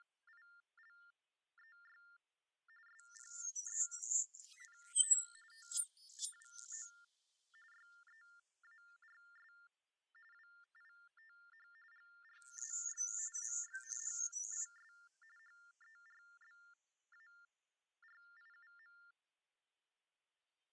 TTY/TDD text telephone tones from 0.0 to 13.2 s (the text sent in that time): … SPENT TWO YEARS WITH GRAY